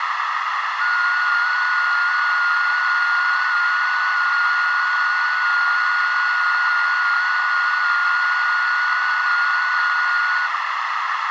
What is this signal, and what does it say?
FT8 (one signal), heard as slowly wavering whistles, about 6.25 baud, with radio static and a narrow filter.